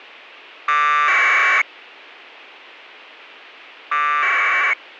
Packet radio (AX.25, as in APRS), 1200 baud, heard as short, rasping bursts.